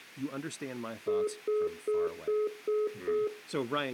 Telephone call progress tone (single-tone plan, as in most of Europe), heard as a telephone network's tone, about 420 Hz, 0.2 s on and 0.2 s off, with room echo and speech in English. Congestion tone.